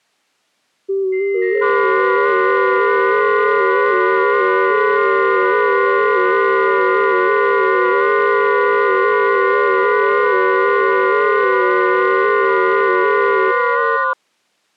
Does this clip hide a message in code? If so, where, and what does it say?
Yes: FT8 (several signals at once) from 0.9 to 14.1 s, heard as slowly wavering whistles, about 6.25 baud.